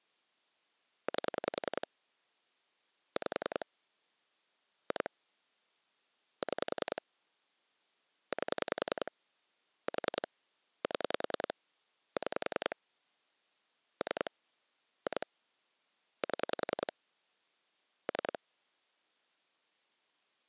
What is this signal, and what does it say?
Pulse dialling, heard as clicks on a phone line, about 10 pulses a second. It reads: 8 5 2 6 8 4 7 6 3 2 7 3